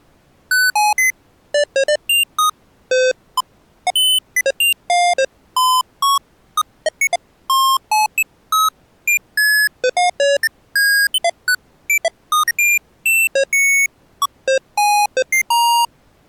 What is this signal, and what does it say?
Electronic bleeps of random pitch and length. There is no code.